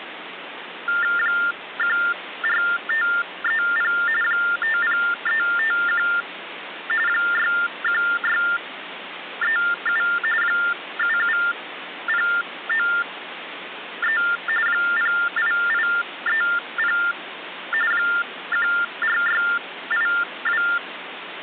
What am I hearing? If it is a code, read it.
TTY/TDD text telephone tones (45.45 baud Baudot), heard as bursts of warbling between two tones, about 400 Hz shift, 1600 Hz centre, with phone line noise. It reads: 14530 50351 61637 77093 08830 14682